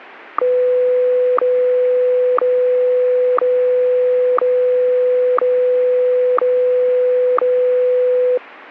Radio time signal (WWVH, Hawaii), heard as ticks, one a second.